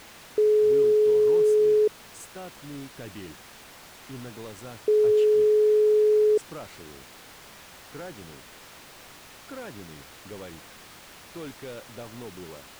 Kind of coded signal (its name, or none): telephone call progress tone